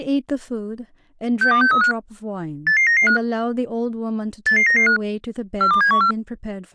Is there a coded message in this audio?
Yes: five-tone selective call (CCIR) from 1.4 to 6.1 s, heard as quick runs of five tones, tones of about 100 ms, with speech in English. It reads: 62635 88995 88995 42714